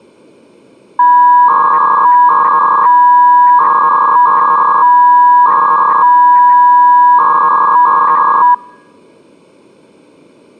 300-baud modem data (V.21 tones), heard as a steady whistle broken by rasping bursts, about 300 baud, 200 Hz shift.